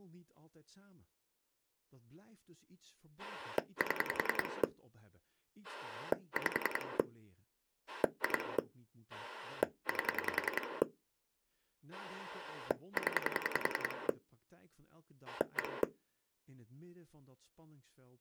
Pulse dialling, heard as a rotary dial, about 10 pulses a second, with speech in Dutch. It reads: 7 5 2 8 0 1